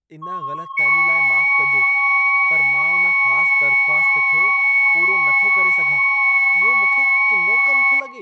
FT8 (several signals at once), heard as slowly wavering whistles, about 6.25 baud, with room echo and speech in Sindhi.